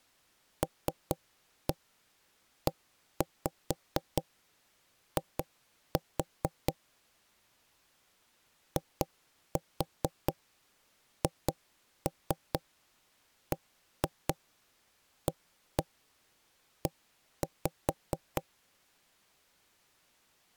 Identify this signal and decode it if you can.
Tap code, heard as knocks on wood, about 4 knocks a second. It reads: LEI IHBAE